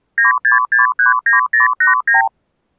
Multi-frequency trunk signalling (R2, with the far end's replies), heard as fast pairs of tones, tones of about 140 ms. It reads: 96639089